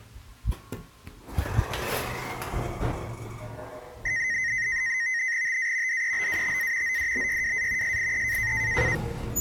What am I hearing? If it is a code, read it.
NAVTEX (SITOR-B), 100 baud, 170 Hz shift, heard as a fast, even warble, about 1950 Hz centre, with the noise inside a lift. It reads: TA DEBATA ODBYWA SIE